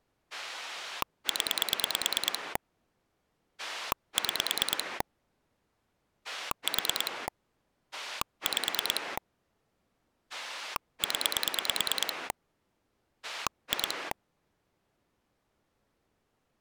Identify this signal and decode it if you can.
Pulse dialling, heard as a rotary dial, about 9 pulses a second. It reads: 0 6 4 5 0 2